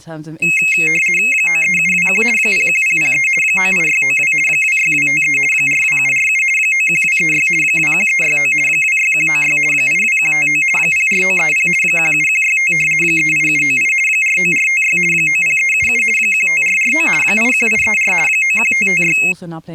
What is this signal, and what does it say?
RTTY (50 baud, 450 Hz shift), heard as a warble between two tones, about 2350 Hz centre, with speech in English. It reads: 93721 01003 98692 26253 42747 91236 21369 26196 82159 04930 17165 38798 49456 90377 15449 81834 91556